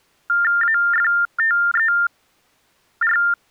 TTY/TDD text telephone tones (45.45 baud Baudot), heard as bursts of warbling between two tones, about 400 Hz shift, 1600 Hz centre. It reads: AFTER